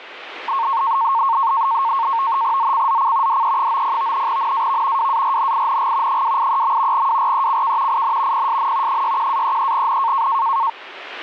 NAVTEX (SITOR-B), 100 baud, 170 Hz shift, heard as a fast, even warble, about 1000 Hz centre, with radio static. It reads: ZCZC DE90 NAV WARNING 283. WRECK IN PSN 61-33N